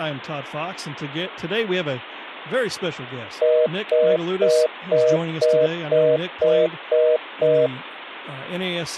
Telephone call progress tone (North American plan), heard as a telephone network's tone, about 480, 620 Hz, 0.25 s on and 0.25 s off, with speech in English. Congestion tone.